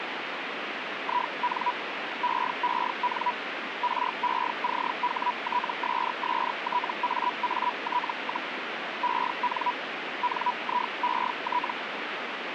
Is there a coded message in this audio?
Yes: Hellschreiber (Feld-Hell, 122.5 baud) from 1.0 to 11.7 s, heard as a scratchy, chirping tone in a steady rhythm, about 980 Hz, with radio static. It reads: IN EEN RECHTSSTAAT, EN NIET